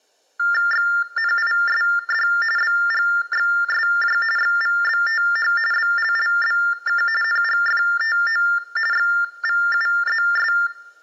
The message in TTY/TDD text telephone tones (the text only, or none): XNISD BGXSJ XVBTH BLLBK NGFTO XVUZS